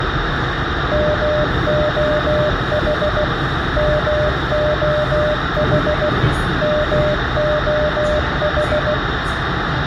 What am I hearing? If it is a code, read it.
Morse code, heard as a keyed tone, machine-sent, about 16 wpm, 600 Hz, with radio hiss, a squelch burst at the end, room echo and the noise inside a subway train. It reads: MOH MOH MOH